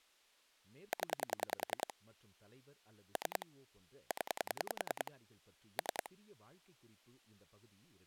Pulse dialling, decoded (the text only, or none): 0 3 0 3